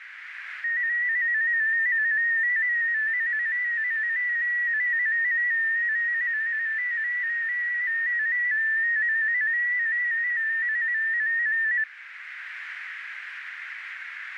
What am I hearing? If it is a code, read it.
Multi-tone FSK (Olivia or MFSK type), about 250 Hz wide, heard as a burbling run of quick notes, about 15.625 baud, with radio static and a narrow filter.